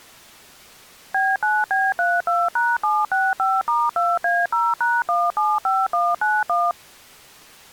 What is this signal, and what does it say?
DTMF, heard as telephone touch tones, dialled by machine, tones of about 220 ms. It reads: B9B32#765*2A0#175191